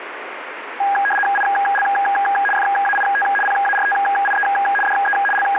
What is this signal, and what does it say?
RTTY (75 baud, 850 Hz shift), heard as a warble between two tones, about 1220 Hz centre, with radio static. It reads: IL FAIT PARTIE DE …